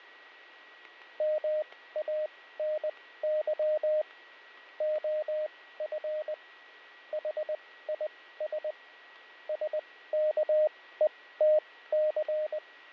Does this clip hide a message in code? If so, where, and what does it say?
Yes: Morse code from 1.1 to 12.9 s, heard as a keyed tone, machine-sent, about 20 wpm, spaced as for 15 wpm, 610 Hz, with fading, static crashes and a steady whistle near 1920 Hz. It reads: MANY OF HIS …